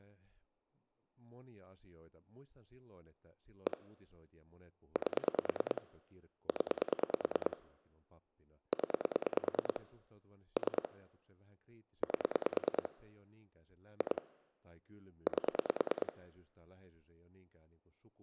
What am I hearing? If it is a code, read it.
Pulse dialling, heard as clicks on a phone line, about 9 pulses a second, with speech in Finnish. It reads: 1 8 0 0 3 8 2 8